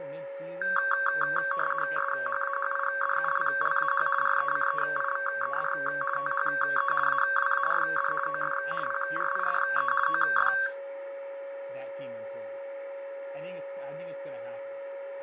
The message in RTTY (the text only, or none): SHAHIDULLAH RECEIVED THE AWARD OF PRIDE OF